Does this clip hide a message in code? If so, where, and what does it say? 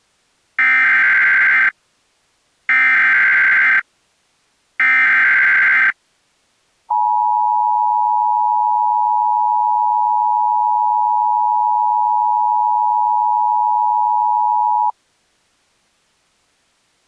Yes: Emergency Alert System (SAME) tones (header bursts, then the 853 and 960 Hz attention tone) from 0.6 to 14.9 s, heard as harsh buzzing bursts, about 520.83 baud.